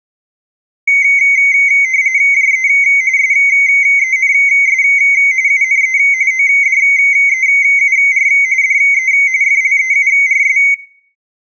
RTTY (45.45 baud, 170 Hz shift), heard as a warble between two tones, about 2150 Hz centre, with room echo. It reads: JE SENS UNE ODEUR DE FLEURS